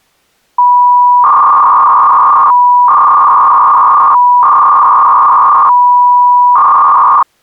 300-baud modem data (V.21 tones), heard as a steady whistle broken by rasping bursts, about 300 baud, 200 Hz shift.